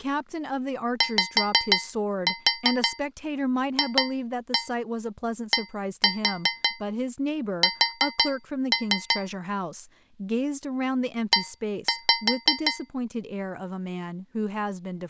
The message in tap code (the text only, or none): YFDS E